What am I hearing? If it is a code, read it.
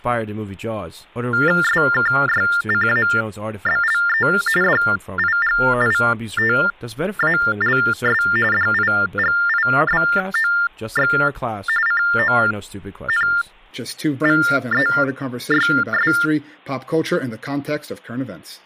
TTY/TDD text telephone tones (45.45 baud Baudot), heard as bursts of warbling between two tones, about 400 Hz shift, 1600 Hz centre, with speech in English. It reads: SKYCABLE DIGITALS DIGIBOX CONVEYS